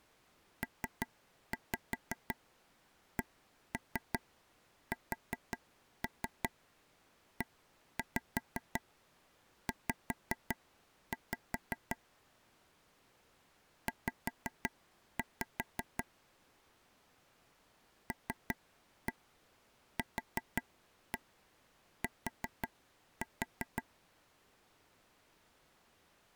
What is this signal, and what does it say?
Tap code, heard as taps on a table, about 5 knocks a second. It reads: PCSEZ Z LQT